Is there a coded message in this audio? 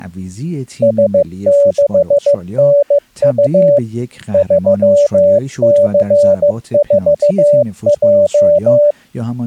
Yes: Morse code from 0.8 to 9.0 s, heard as a keyed tone, machine-sent, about 15 wpm, 580 Hz, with speech in Persian. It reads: S6NU 3C4J